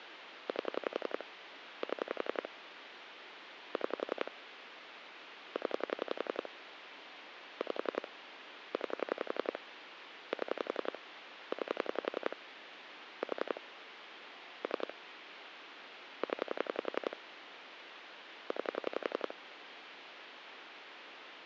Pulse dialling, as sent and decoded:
8 / 7 / 6 / 10 / 5 / 9 / 7 / 9 / 4 / 3 / 10 / 9
8 7 6 0 5 9 7 9 4 3 0 9

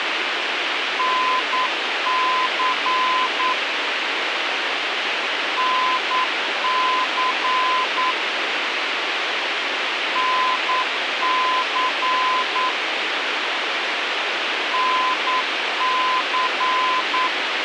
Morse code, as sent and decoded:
-. -.-. / -. -.-. / -. -.-. / -. -.-.
NC NC NC NC

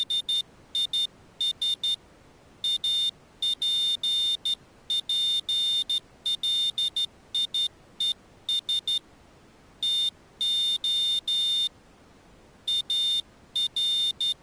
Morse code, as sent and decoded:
… / .- .--. .--. .-.. .. . ... / - --- / …
… APPLIES TO …

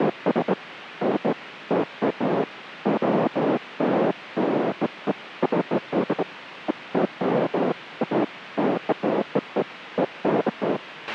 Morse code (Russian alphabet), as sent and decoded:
none

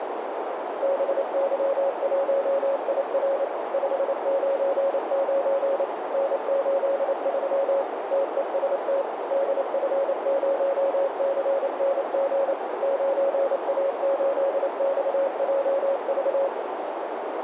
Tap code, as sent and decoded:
none

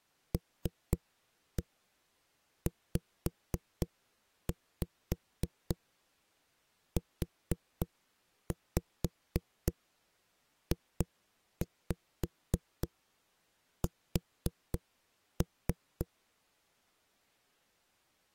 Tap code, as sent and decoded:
3-1 5-5 4-5 2-5 4-3
LZUJS

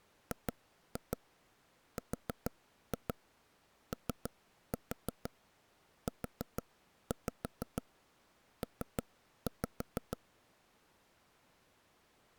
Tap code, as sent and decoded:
2-2 4-2 3-4 4-5 3-5
GROUP

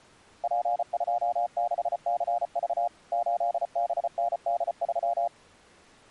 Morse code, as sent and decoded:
.--. ..--- -.... -.-. ...- / ---.. -... -. -.. ...--
P26CV 8BND3

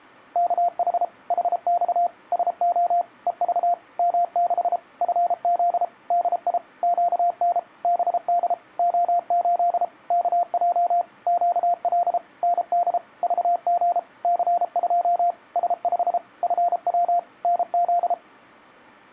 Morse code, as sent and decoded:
-.- .... / .... -..- / ... --- / . ...- / -- -.... / ..-. --.. / -.. .. / --.- -. / -... -.. / --- ---.. / -.- .--- / --.- .-.. / -. -.. / ...- --. / -.-. ..--- / ... ..... / ..-. .-- / -. --..
KH HX SO EV M6 FZ DI QN BD O8 KJ QL ND VG C2 S5 FW NZ

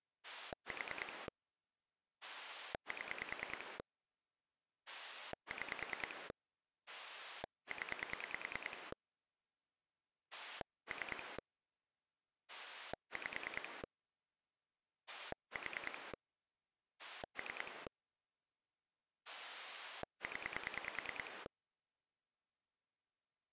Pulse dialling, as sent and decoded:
4 / 7 / 6 / 10 / 3 / 5 / 4 / 3 / 10
4 7 6 0 3 5 4 3 0

